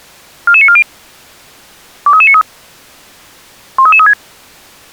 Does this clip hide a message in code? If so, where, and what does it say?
Yes: five-tone selective call (ZVEI) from 0.5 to 4.1 s, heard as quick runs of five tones, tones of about 70 ms. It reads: 44940 23393 13336